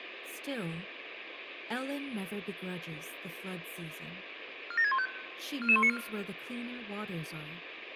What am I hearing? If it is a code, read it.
Five-tone selective call (ZVEI), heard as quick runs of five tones, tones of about 70 ms, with radio hiss. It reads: 47615 44194